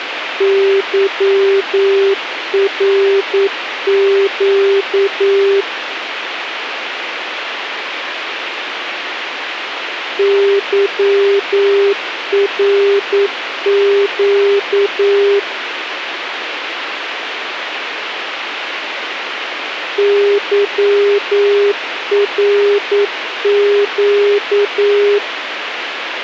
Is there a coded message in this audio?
Yes: Morse code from 0.3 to 25.2 s, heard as a keyed tone, machine-sent, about 9 wpm, 400 Hz, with radio hiss. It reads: YRQ YRQ YRQ